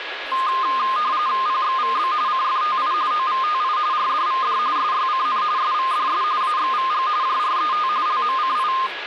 RTTY (45.45 baud, 170 Hz shift), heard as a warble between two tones, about 1140 Hz centre, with radio static, a steady whistle near 1670 Hz and speech in Marathi. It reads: PXVB CFTI OVTI RDVD SYCN SVDS AXVG JRET LMCI